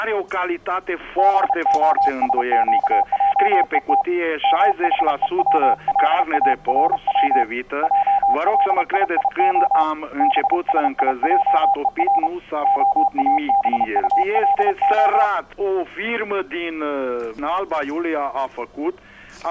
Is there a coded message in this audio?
Yes: Morse code (Hebrew alphabet) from 1.1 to 15.3 s, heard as a keyed tone, hand-sent with a paddle, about 31 wpm, 800 Hz. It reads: בהשקעות מחוץלארץ עלייה בשיעור האבטלה